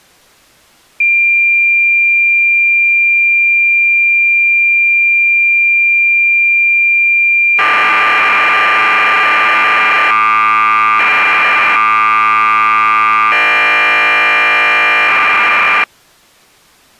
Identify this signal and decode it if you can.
Cassette data (Kansas City type), 1200 baud, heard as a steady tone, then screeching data.